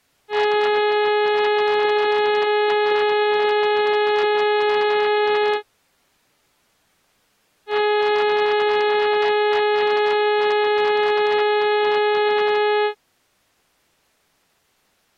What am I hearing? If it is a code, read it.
Ship horn signal, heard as a ship's horn, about 420 Hz. 2 long. At sea: a vessel under power that has stopped in fog.